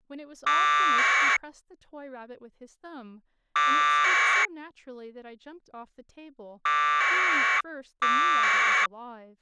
Packet radio (AX.25, as in APRS), 1200 baud, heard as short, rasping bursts, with speech in English.